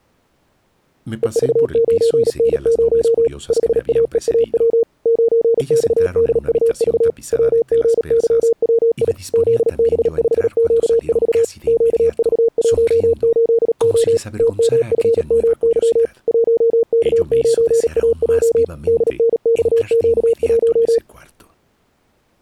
Morse code, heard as a keyed tone, machine-sent, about 37 wpm, 460 Hz. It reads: EV9N0 5AEAW 9XDUV WGYWI ZB5Q4 QV18O TMFMY 1K9AJ DNXQ1